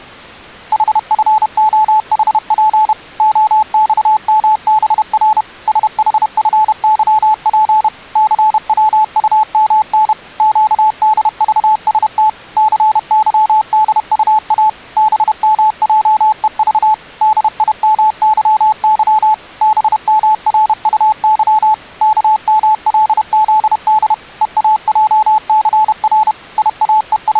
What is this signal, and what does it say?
Morse code, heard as a keyed tone, machine-sent, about 31 wpm, 860 Hz. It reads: HFOHP OXMBR SHFYP CWUMN QDVST CYDUA BMJEV DIMYY BMRUY KMLZD EAJCR …